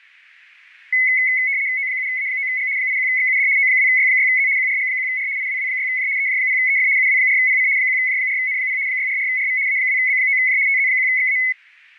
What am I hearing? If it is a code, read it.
RTTY (75 baud, 170 Hz shift), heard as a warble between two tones, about 2100 Hz centre. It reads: O7A9G 81XUD O2Y6Z QRG1R IWW6J EJ0EF UW4PC 1J4N0 644RV A2B9J TZ1XA